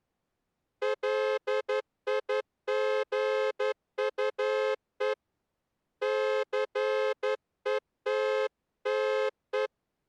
Morse code, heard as a horn, hand-sent with a straight key, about 11 wpm. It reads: LIGUE CETTE